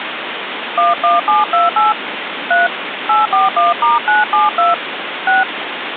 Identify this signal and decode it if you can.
DTMF, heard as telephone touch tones, dialled by hand, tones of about 160 ms, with phone line noise. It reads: 11728 3 841*972 6